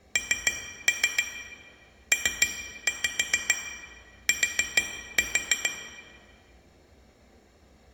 Tap code, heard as taps on glass, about 6 knocks a second, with room echo. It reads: NPT